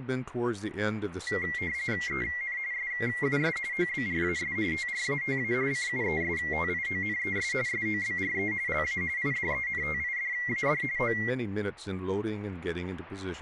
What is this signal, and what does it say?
RTTY (45.45 baud, 170 Hz shift), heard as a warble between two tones, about 2050 Hz centre, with speech in English. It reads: EN SUS OBRAS TRATA CUESTIONES SOBRE LA IDENTIDAD O